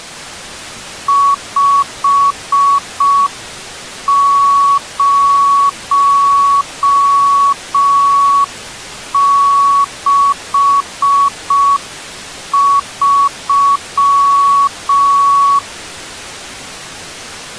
Morse code, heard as a keyed tone, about 5 wpm, 1120 Hz. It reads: 5063